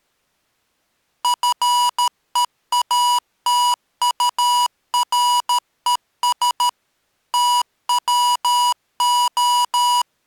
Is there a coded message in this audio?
Yes: Morse code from 1.2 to 10.1 s, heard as electronic beeps, machine-sent, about 13 wpm, 980 Hz. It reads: FEATURES TWO